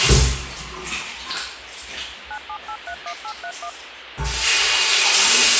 DTMF, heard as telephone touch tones, dialled by machine, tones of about 70 ms, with phone line noise. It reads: 97831831